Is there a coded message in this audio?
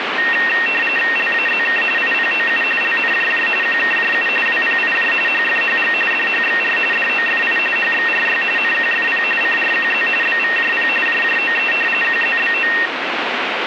Yes: RTTY (45.45 baud, 850 Hz shift) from 0.2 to 12.9 s, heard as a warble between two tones, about 2300 Hz centre, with radio static. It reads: LAZK IPOU LNJJ QKJU WPIJ HFHG DHXR DOFI HXRY NQFP CRQZ BVJP JJOE QZBO